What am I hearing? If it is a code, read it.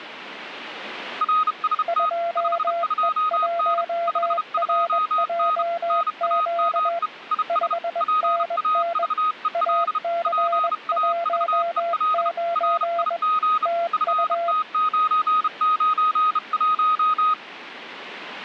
Morse code, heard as two keyed tones. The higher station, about 32 wpm, 1250 Hz: RST 52N 52N NAME IS PAVEL PAVEL RIG FT991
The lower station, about 21 wpm, 680 Hz: 2E1RJQ 5NN AC19 TU